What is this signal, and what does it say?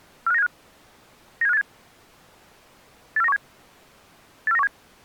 Five-tone selective call (EEA), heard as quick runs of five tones, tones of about 40 ms. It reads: 45975 97587 84917 84917